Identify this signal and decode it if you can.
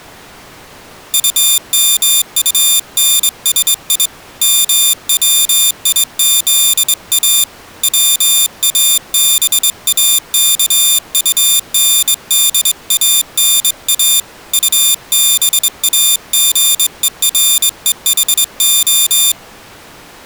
Morse code, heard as a high beeper, hand-sent with a straight key, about 22 wpm, 3600 Hz. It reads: UMUNSI MWIZA WABAKUNDANA UBAGEREHO